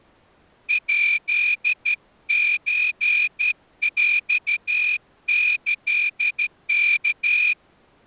Morse code (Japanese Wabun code), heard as a whistle, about 13 wpm. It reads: ヱソヰキワ